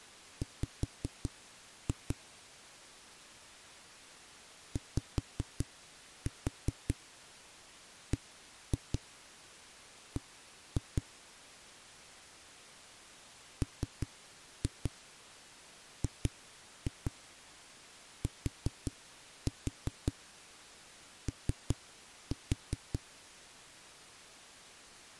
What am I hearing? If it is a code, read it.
Tap code, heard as knocks on a wall, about 5 knocks a second. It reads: W YBB MGTO